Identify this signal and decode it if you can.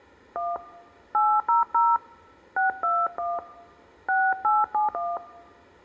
DTMF, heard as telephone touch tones, dialled by hand, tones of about 180 ms. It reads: 1 800 621 6871